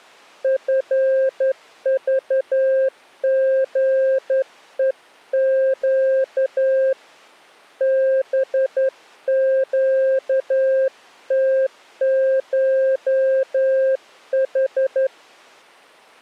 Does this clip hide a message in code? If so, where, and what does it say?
Yes: Morse code (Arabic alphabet) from 0.4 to 15.1 s, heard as a keyed tone, hand-sent with a straight key, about 11 wpm, 530 Hz. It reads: فضغءق بقتشح